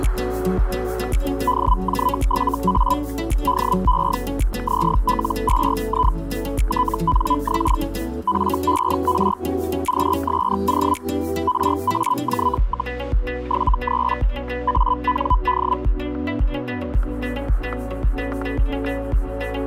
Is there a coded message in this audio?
Yes: Hellschreiber (Feld-Hell, 122.5 baud) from 1.5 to 15.8 s, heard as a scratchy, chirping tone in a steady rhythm, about 1000 Hz, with static crashes. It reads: DJ7A DE ZL2I TNX FER QSO RAJ, 73 AND